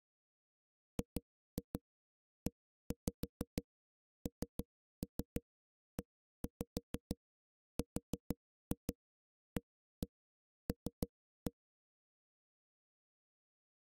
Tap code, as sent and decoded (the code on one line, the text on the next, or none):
2-2 1-5 3-3 1-5 4-2 1-1 3-1
GENERAL